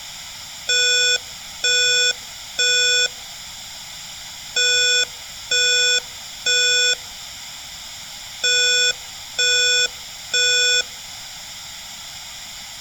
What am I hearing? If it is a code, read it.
Alarm pattern, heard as an alarm's beeps, played three times, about 490 Hz, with room echo. Temporal three. Smoke or fire, evacuate.